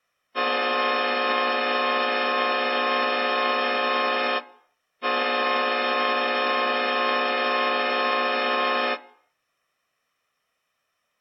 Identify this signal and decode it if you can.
Train horn signal, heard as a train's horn. 2 long. On North American railways: brakes released, proceed.